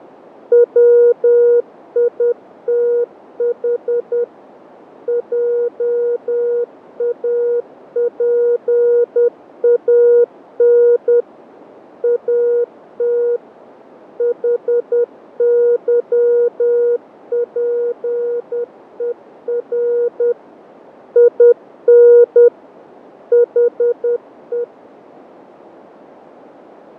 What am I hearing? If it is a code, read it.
Morse code, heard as a keyed tone, machine-sent, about 10 wpm, 480 Hz, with radio static and fading. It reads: WITH JAPAN AT HYPER IN HE